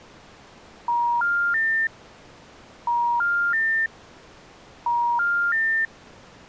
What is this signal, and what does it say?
Telephone call progress tone (ITU plan), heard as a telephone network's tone, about 950, 1400, 1800 Hz. Special information tone.